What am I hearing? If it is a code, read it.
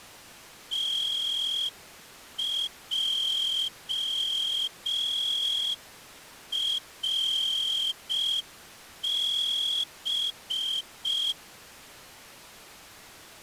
Morse code (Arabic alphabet), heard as a whistle, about 5 wpm. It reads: تجرب